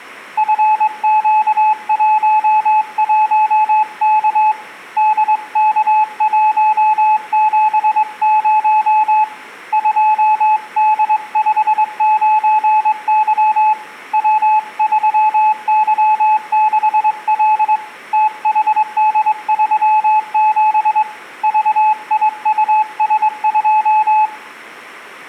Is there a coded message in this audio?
Yes: Morse code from 0.3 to 24.3 s, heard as a keyed tone, hand-sent with a straight key, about 22 wpm, 860 Hz, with room echo. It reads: FQ11K DK170 2D59Y W3Y6L THD37 VIUS2